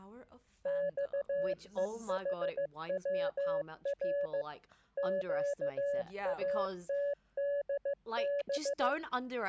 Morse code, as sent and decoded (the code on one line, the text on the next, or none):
-..- . .... .-- .-. / --.- .- - -.. -...
XEHWR QATDB